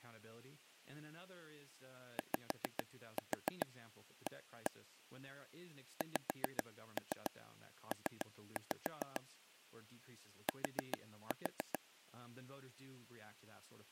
Tap code, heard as taps on a table, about 7 knocks a second, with speech in English. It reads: YA XP T